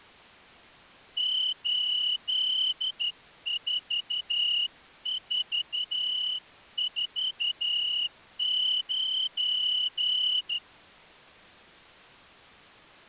Morse code, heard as a whistle, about 12 wpm. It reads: 84449